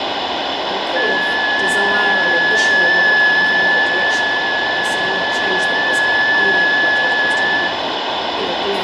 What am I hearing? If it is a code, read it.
FT8 (one signal), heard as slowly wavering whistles, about 6.25 baud, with radio static, fading and room echo.